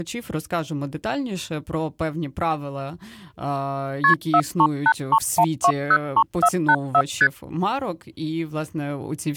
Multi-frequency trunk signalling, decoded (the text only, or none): KP 43831203484 ST